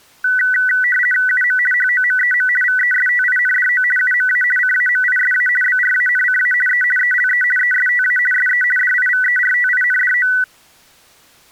RTTY (50 baud, 450 Hz shift), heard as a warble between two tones, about 1750 Hz centre. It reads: UM HOMEM VESTINDO UMA CAMISA BRANCA E ELE ESTA SE DIVERTINDO